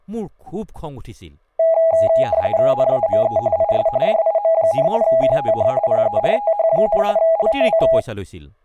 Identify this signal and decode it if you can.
RTTY (45.45 baud, 170 Hz shift), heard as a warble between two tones, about 740 Hz centre, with speech in Assamese. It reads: NAME IS JIM, QTH PERTH, LOC